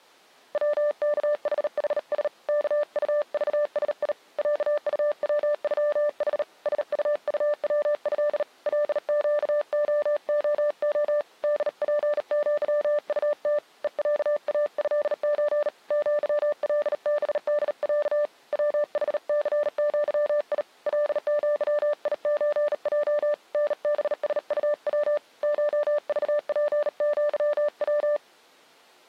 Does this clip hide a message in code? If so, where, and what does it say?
Yes: Morse code (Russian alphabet) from 0.5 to 28.2 s, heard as a keyed tone, hand-sent with a bug key, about 38 wpm, 590 Hz. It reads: ВКХХС КУЖСИ ЯУВЮХ СУУВЭ ЛЩООО ДПЪУТ ЕЯАЭЧ ЪЛБДЯ ВХЦЪИ ЛЪИЧЙ НБСУВ ШЖПЪВ